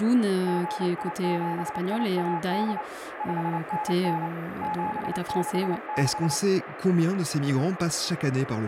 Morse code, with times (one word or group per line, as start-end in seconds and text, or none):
0.5-2.8 GI7IAD
3.2-4.3 5NN
4.6-6.3 766